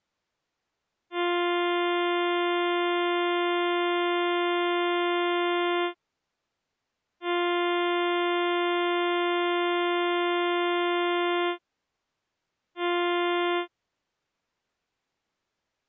Ship horn signal, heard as a ship's horn, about 350 Hz. 2 long, 1 short. At sea: I intend to overtake on your starboard side.